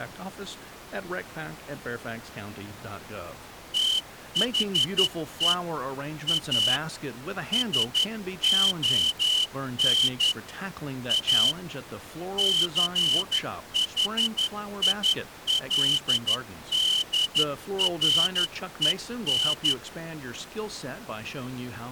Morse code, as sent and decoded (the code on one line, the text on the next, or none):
- .... . / .- / ... --- -. / .- / -.-. .... .. .-.. -.. .-. . -.
THE A SON A CHILDREN